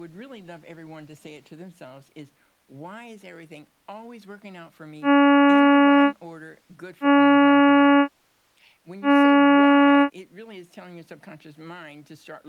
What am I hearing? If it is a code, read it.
Ship horn signal, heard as a ship's horn, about 280 Hz, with speech in English. 3 short. At sea: I am operating astern propulsion.